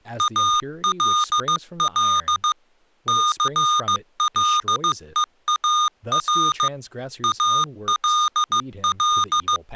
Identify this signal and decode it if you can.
Morse code, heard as electronic beeps, machine-sent, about 15 wpm, 1220 Hz, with speech in English. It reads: ALL CLEAR ALL